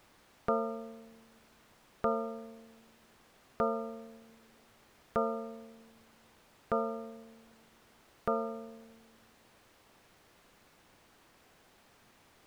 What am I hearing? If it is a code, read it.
Clock strike, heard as a bell. 6. Six o'clock.